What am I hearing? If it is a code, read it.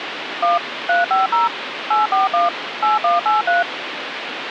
DTMF, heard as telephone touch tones, dialled by machine, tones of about 160 ms, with phone line noise. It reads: 1 350 841 8183